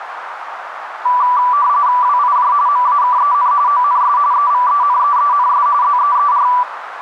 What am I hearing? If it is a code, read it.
RTTY (45.45 baud, 170 Hz shift), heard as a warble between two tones, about 1070 Hz centre, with radio static and a narrow filter. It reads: WIJ MAKEN ONS EVENEENS ZEER